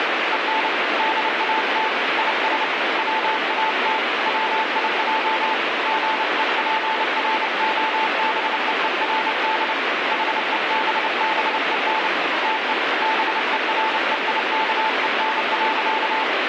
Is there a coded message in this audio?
Yes: Morse code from 0.3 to 16.3 s, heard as a keyed tone, hand-sent with a paddle, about 29 wpm, 880 Hz, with heavy radio static. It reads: EN DAT IS WAT WIJ GEPROBEERD HEBBEN TE BEREIKEN.